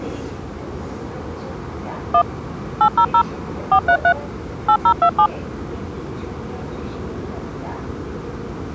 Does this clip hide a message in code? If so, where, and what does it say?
Yes: DTMF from 2.1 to 5.3 s, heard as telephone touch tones, dialled by machine, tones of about 80 ms, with the noise inside a subway train. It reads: 1 800 433 8027